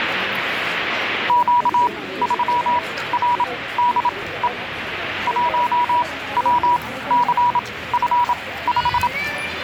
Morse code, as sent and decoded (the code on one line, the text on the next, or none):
--.- ...-- .-. -.. . / .---- .-- -.-. ..-. .....
Q3RDE 1WCF5